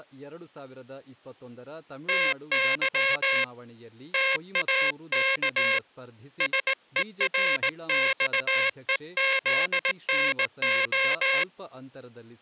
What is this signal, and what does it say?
Morse code (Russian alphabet), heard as a buzzer, hand-sent with a straight key, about 18 wpm, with speech in Kannada. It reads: ТЫ ТАК СЕРЬЕЗНО